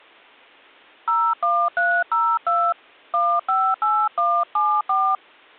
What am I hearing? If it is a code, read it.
DTMF, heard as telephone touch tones, dialled by hand, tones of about 260 ms. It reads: 01302 158174